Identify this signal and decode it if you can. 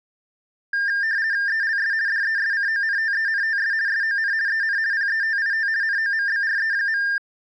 RTTY (50 baud, 170 Hz shift), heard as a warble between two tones, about 1700 Hz centre. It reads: ELS DESCONTENTS SON EN PETIT NOMBRE.